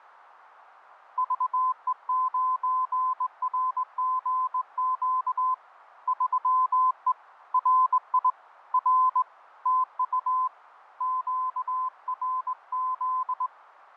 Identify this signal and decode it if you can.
Morse code, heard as a keyed tone, hand-sent with a straight key, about 20 wpm, 1020 Hz, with fading. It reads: VE9RGQ 3E RI R TU QRZ